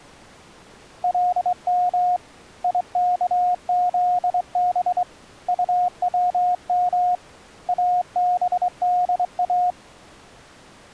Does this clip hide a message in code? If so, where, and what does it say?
Yes: Morse code (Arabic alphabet) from 1.0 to 9.8 s, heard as a keyed tone, hand-sent with a straight key, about 23 wpm, 720 Hz. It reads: لم يكذب طوم ابدا